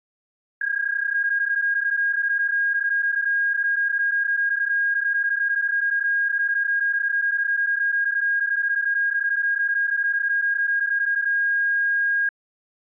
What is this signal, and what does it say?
PSK31 (31.25 baud), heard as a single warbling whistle, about 1650 Hz.